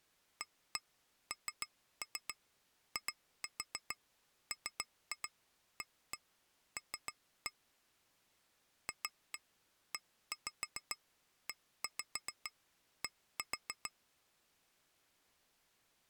Tap code, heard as taps on glass, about 7 knocks a second. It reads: ANIMAL FEED